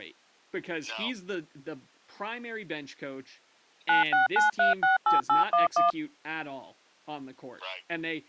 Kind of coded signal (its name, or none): DTMF